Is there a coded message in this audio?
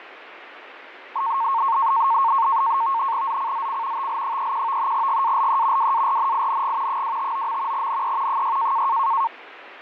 Yes: NAVTEX (SITOR-B), 100 baud, 170 Hz shift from 1.2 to 9.3 s, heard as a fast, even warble, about 1000 Hz centre, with radio static. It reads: ZCZC TL31 GALE WARNING 259. NE 6